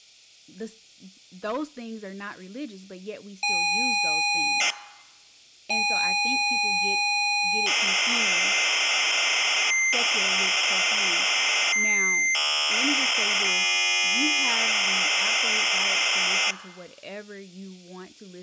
ZX Spectrum tape loading, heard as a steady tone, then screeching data, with speech in English.